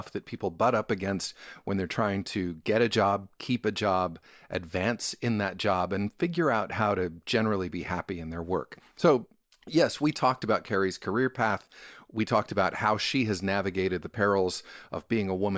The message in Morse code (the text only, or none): none